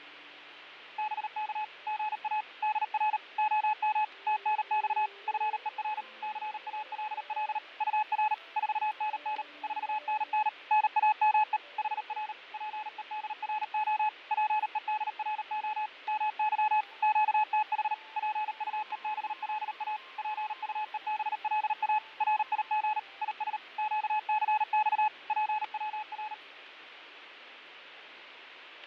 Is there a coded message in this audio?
Yes: Morse code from 0.9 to 26.4 s, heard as a keyed tone, machine-sent, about 38 wpm, 860 Hz, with radio static and fading. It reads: BK GA DR OM TNX FER CALL UR 4NN 4NN NAME HR PEDRO PEDRO MY QTH PUEBLA PUEBLA RIG IS QCX PWR